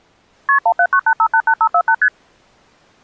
Multi-frequency trunk signalling (R1, as on North American trunks), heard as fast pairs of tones, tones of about 70 ms. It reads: KP 1798588548 ST